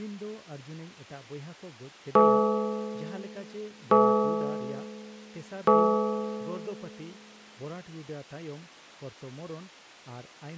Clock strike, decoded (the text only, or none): 3